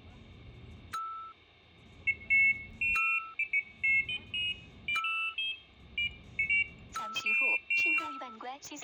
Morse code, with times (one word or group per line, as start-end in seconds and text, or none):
none